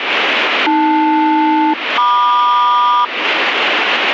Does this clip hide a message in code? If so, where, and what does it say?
Yes: aircraft SELCAL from 0.7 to 3.0 s, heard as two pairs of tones, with radio static. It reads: AL-MQ